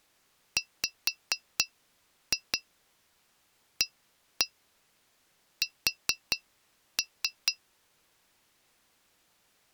Tap code, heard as taps on glass, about 4 knocks a second. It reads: WAS